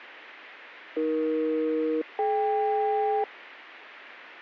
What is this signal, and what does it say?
Aircraft SELCAL, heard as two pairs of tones. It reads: AE-DK